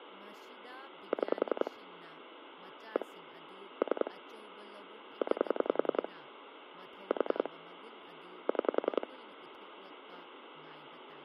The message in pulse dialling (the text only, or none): 6 1 3 9 4 6